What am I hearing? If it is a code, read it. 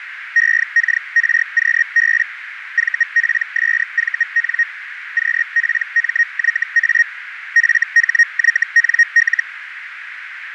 Hellschreiber (Feld-Hell, 122.5 baud), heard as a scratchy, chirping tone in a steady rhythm, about 1850 Hz, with radio static and a narrow filter. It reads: EKRQB VPSVN QPMYA FHYNL